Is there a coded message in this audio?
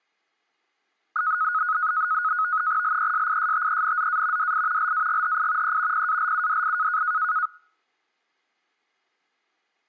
Yes: NAVTEX (SITOR-B), 100 baud, 170 Hz shift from 1.2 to 7.5 s, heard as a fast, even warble, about 1360 Hz centre. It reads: LESISTENZA DI LAGHI E PALUDI